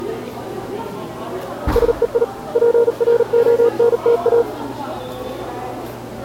Morse code, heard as a keyed tone, hand-sent with a paddle, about 39 wpm, 470 Hz, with the noise of a cafe. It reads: SEI PRONTA